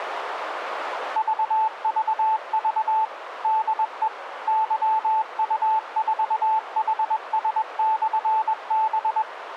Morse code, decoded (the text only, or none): VVV DE YU4HS/B